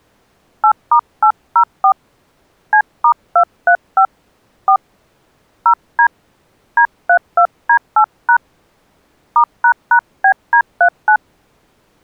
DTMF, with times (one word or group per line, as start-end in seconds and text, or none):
0.6-1.9 8*804
2.7-4.1 C*235
4.7-4.8 4
5.7-6.1 0D
6.8-8.4 D32D8#
9.4-11.2 *##BD39